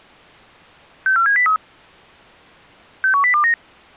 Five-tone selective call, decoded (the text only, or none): 64703 61029